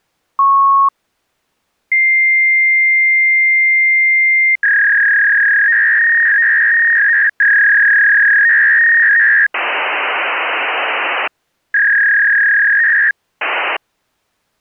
Fax machine handshake, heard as a beep, a long tone, a warble and hiss.